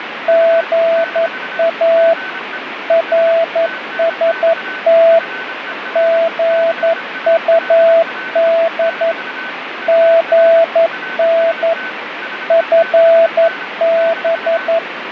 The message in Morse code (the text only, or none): GA RST GUD GN FB